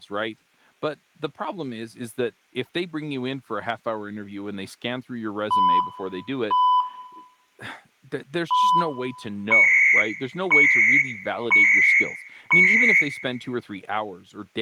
Radio time signal (CHU, Canada), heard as beeps and data bursts, one a second, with room echo and speech in English.